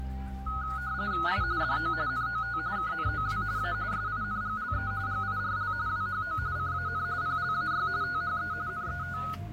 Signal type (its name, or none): RTTY